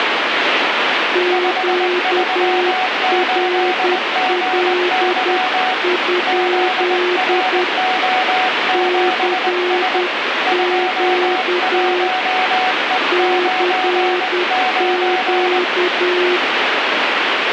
Morse code, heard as two keyed tones, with radio static. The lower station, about 10 wpm, 360 Hz: QRL? CQ CQ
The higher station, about 20 wpm, 740 Hz: 538GY ZRO7S 21E99